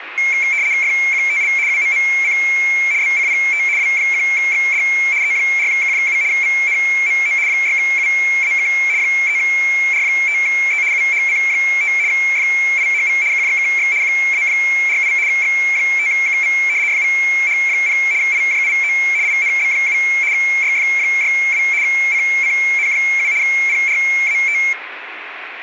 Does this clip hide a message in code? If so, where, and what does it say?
Yes: RTTY (75 baud, 170 Hz shift) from 0.2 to 24.7 s, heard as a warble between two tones, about 2250 Hz centre, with radio static and room echo. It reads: FQTL UMMC BCPT W1XD E4K7 VNMO 6UAK 3R5E UHC5 FIHV KJKX QA48 X5KV FVH0 IJIO INB7 YF62 CCN7 PRAT